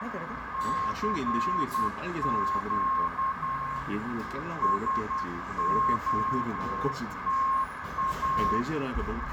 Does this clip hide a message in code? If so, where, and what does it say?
Yes: Morse code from 0.5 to 8.7 s, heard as a keyed tone, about 10 wpm, 1070 Hz, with heavy radio static, fading, a narrow filter and the noise of a cafe. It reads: CQ SOTA